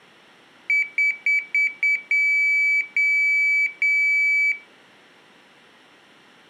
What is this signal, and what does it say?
Beep code, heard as a piezo beeper, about 2300 Hz, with room echo. 5 short, 3 long.